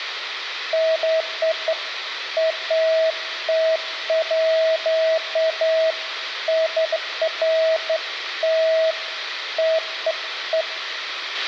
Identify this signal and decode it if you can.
Beeps of irregular length, with a squelch burst at the end and room echo. There is no code.